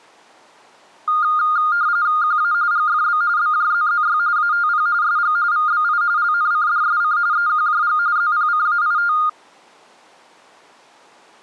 RTTY (45.45 baud, 170 Hz shift), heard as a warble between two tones, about 1320 Hz centre. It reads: QA GFB BJZZY ATP SG VBI LNCDSC EQJG ZPCAIT